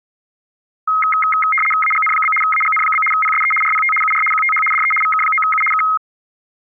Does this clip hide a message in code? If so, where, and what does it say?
Yes: RTTY (75 baud, 850 Hz shift) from 0.9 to 6.0 s, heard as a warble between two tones, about 1700 Hz centre. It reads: AGN? AGN? PSE RPT UR QTH DE VK9U K